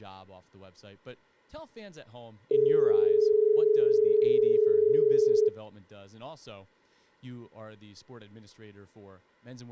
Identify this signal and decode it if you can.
Telephone call progress tone (as in Australia), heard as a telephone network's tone, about 430 Hz, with room echo and speech in English. Dial tone.